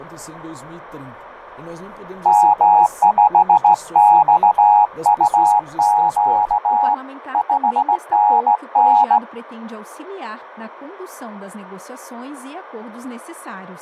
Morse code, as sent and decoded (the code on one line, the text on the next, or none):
-- ..... -..- ..- --.- / ..... -. -.
M5XUQ 5NN